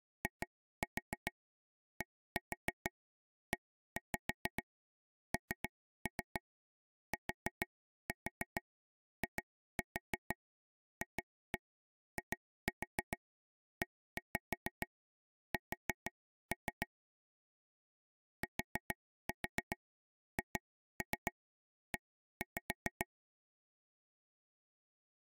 Tap code, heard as taps on a table, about 6 knocks a second. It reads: IDENTIFIES THE